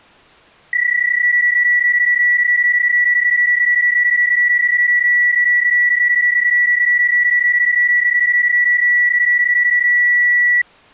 PSK31 (31.25 baud), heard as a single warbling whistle, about 1950 Hz.